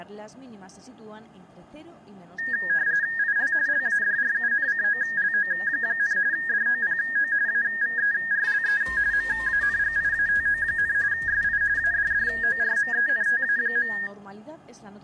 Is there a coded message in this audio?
Yes: RTTY (45.45 baud, 170 Hz shift) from 2.4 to 14.1 s, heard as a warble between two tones, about 1750 Hz centre, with room echo. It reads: IL LADRUNCOLO, DOPO AVERLE MANGIATO, SI ADDORMENTA.